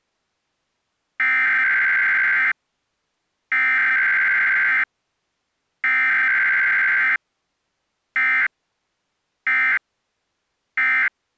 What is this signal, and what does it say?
Emergency Alert System (SAME) tones (header bursts, then end-of-message bursts), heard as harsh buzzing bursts, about 520.83 baud.